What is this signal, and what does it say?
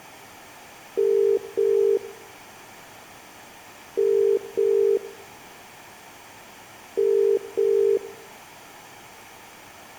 Telephone call progress tone (as in the UK, Ireland, Australia and similar networks), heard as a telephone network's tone, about 400, 450 Hz, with room echo. Ringback tone.